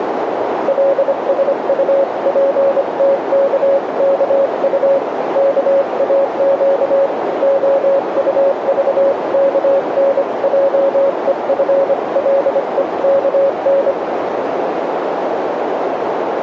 Morse code (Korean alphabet), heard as a keyed tone, hand-sent with a paddle, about 25 wpm, 550 Hz, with radio static and a narrow filter. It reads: 계정이 왜 필요한가요